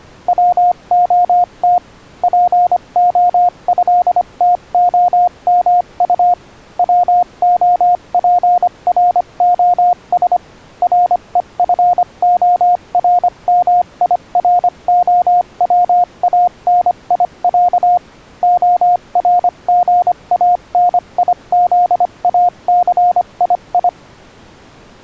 Morse code (Russian alphabet), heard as a keyed tone, machine-sent, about 25 wpm, spaced as for 22 wpm, 710 Hz. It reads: ВОТ ПОЭТОМУ ВОПРОС РЕФОРМИРОВАНИЯ ОРГАНИЗАЦИИ